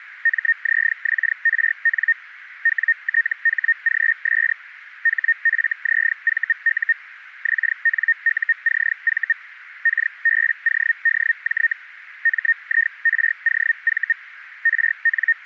Hellschreiber (Feld-Hell, 122.5 baud), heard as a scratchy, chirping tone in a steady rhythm, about 1850 Hz, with radio static. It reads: MZXRN WTHGS HFZVU XNUCV KBODJ MIROV …